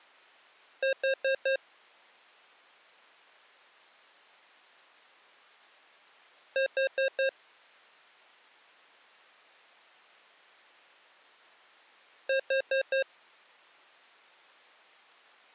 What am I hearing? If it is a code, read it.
Alarm pattern, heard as an alarm's beeps, played three times, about 540 Hz. Temporal four. Carbon monoxide.